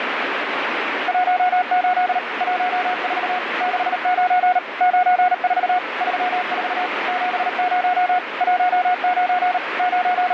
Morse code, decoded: 18 14 69 94 34 70 19 …

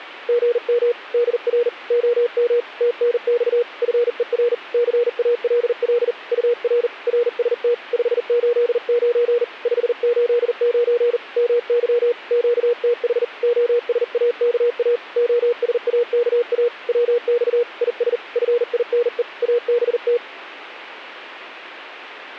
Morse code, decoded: GM DR OM TNX FER CALL UR RST 589 589 MY QTH OSAKA OSAKA WX IS FINE ABT

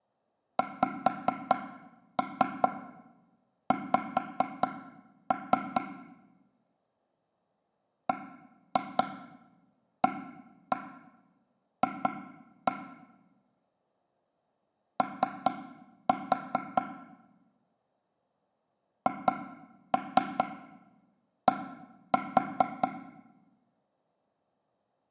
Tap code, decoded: XX BAF O HD

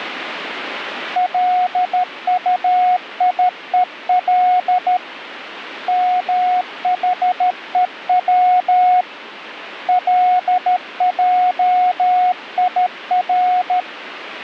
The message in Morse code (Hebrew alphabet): לטיול מחוץ לעיר

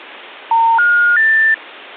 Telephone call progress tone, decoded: special information tone

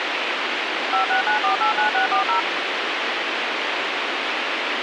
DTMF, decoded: 569489640

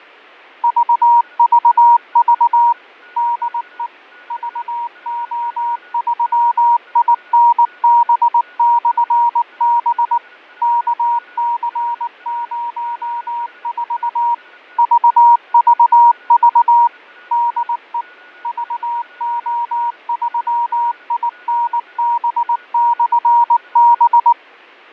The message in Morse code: VVV DE VO3INB/B KC04 VVV DE VO3INB/B

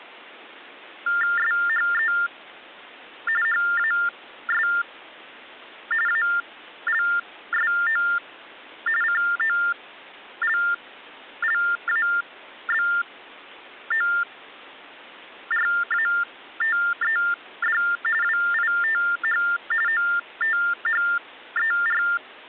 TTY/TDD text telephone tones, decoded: SHE HAS ALSO COLLABORATED WITH OTHER

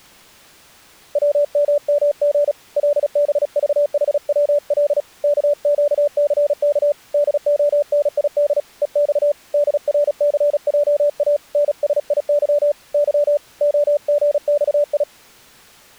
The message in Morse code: WMMG LBVHWL KQCK DONID EX DRCJA NSIY Y OGXI

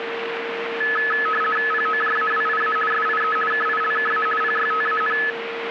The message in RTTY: POJAWIA SIE KILKA PYTAN

